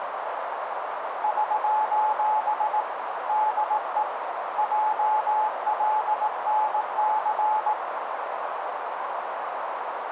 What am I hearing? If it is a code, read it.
Morse code, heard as a keyed tone, hand-sent with a paddle, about 18 wpm, 860 Hz, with radio static and a narrow filter. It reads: <SOS> DE JLNC